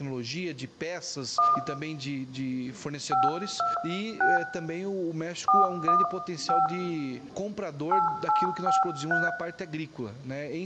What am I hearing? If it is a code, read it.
DTMF, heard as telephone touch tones, dialled by hand, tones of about 170 ms, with room echo. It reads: 1 526 415 8853